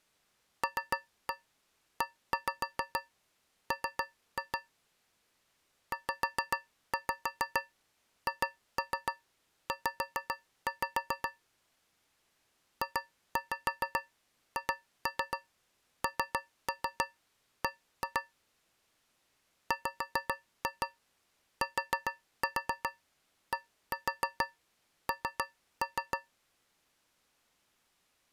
Tap code, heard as taps on a metal pipe, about 7 knocks a second. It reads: LEM ZHZ JHNB WTDN